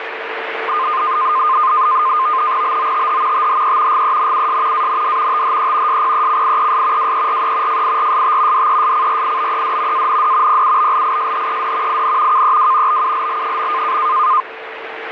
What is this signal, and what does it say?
NAVTEX (SITOR-B), 100 baud, 170 Hz shift, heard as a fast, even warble, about 1130 Hz centre, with radio static and a steady whistle near 450 Hz. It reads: BOTH THE GENUS AND THE SPECIES WERE FIRST DESCRIBED AND PUBLISHED IN KEW BULL.